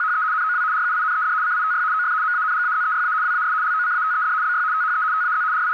RTTY (75 baud, 170 Hz shift), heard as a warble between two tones, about 1360 Hz centre, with radio static and a narrow filter. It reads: … NOW RUINED CITY OF MANGAZEYA WAS LOCATED BY THE TAZ …